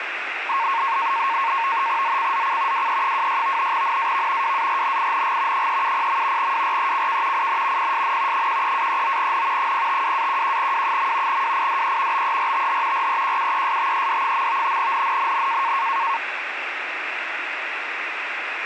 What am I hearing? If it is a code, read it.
NAVTEX (SITOR-B), 100 baud, 170 Hz shift, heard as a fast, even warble, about 1000 Hz centre, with radio static. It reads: ZCZC WE26 NAV WARNING 370. WRECK IN PSN 13-39N 052-11W. WIDE BERTH REQUESTED. NNNN